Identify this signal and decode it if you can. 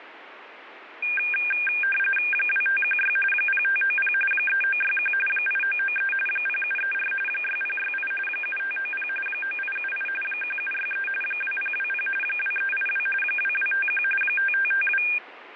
RTTY (45.45 baud, 850 Hz shift), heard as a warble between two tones, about 2000 Hz centre, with radio static. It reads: 2516 0590 3961 8993 0734 6068 7590 9878 1763 2020 2382 2251 5552